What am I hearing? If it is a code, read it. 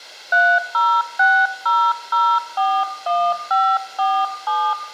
DTMF, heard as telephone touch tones, dialled by hand, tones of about 260 ms, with room echo. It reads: 3060041547